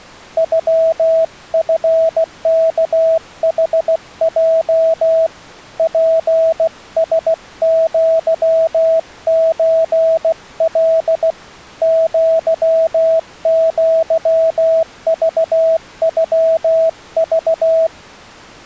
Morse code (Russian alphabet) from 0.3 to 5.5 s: ЮФКХЙ

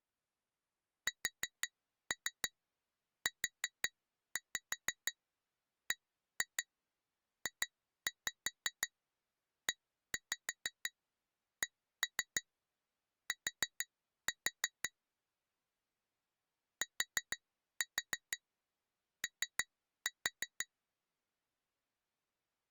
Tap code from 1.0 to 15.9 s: SUBJECT

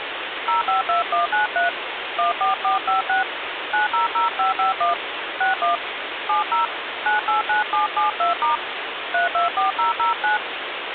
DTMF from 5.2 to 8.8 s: 61 70 989772*

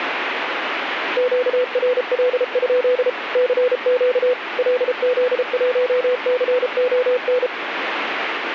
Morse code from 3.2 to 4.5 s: CQ

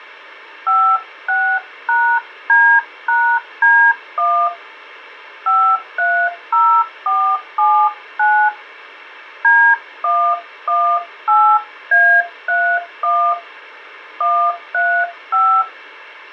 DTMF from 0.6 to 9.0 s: 56#D#D1 530479

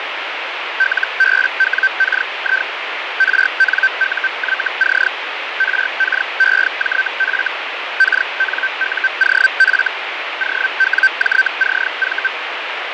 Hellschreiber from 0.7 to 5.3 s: LBWKI RNUYC

